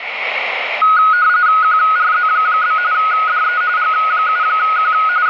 RTTY (45.45 baud, 170 Hz shift), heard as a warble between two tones, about 1360 Hz centre, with radio static. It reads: QRZ? DE G7Q …